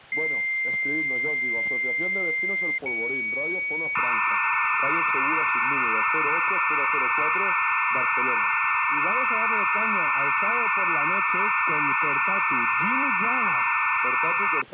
Dial-up modem handshake (low-speed, two carriers), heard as two whistles, then hiss.